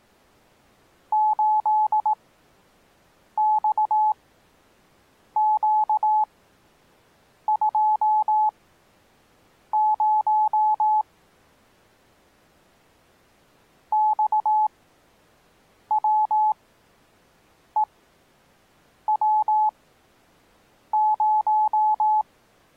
Morse code, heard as a keyed tone, machine-sent, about 18 wpm, spaced as for 6 wpm, 860 Hz. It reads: 8XQ20 XWEW0